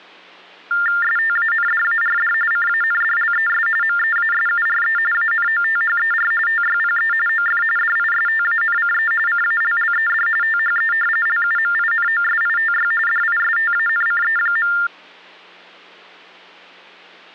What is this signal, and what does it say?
TTY/TDD text telephone tones (45.45 baud Baudot), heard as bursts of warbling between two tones, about 400 Hz shift, 1600 Hz centre. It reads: STANDARD CANDLES MEASURE ANOTHER TYPE OF DISTANCE CALLED THE LUMINOSITY DISTANCE.